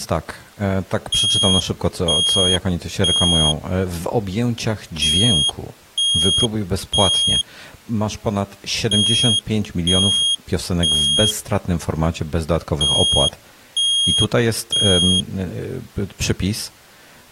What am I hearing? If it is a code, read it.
Alarm pattern, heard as an alarm's beeps, played four times, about 3250 Hz, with speech in Polish. Temporal three. Smoke or fire, evacuate.